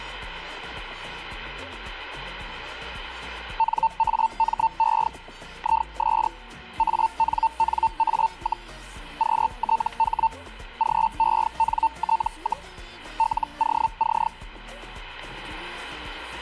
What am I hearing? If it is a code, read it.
Hellschreiber (Feld-Hell, 122.5 baud), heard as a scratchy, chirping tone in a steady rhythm, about 900 Hz, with static crashes. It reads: NAME IS ANNA, QTH GENT, LOC